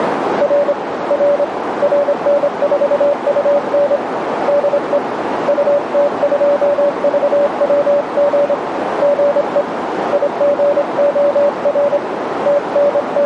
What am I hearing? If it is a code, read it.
Morse code, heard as a keyed tone, hand-sent with a straight key, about 26 wpm, 570 Hz, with radio static and a narrow filter. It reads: R R RN4UN DE UT2VWG GE IGOR …